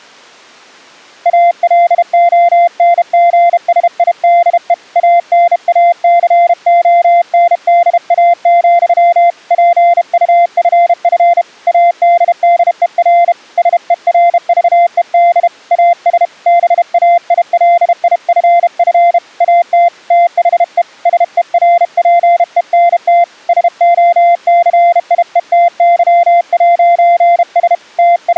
Morse code, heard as a keyed tone, hand-sent with a bug key, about 32 wpm, 690 Hz. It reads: ALONGSIDE ANACONDA, PUFF ADDER SERVED AS BAILIFF AT THE SERPENT SOCIETY'S …